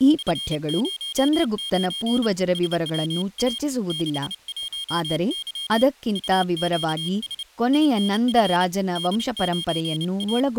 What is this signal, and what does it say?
Morse code, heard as a high beeper, hand-sent with a paddle, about 29 wpm, 3200 Hz, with speech in Kannada. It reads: F09 SWA 61Y UQS INF D9A